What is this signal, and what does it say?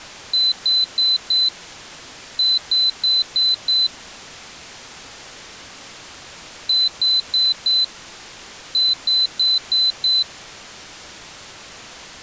Beep code, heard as a piezo beeper, played twice, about 4050 Hz. 4-5.